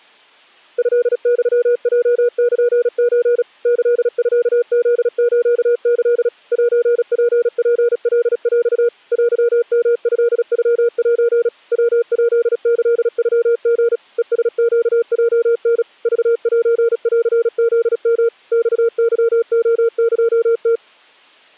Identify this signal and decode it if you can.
Morse code (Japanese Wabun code), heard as a keyed tone, machine-sent, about 36 wpm, 470 Hz. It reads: トユヲルソ キミフスキ セツツカヰ テヨトノセ ヤヱキノリ ヘラネヲタ クセンフヨ マケレエム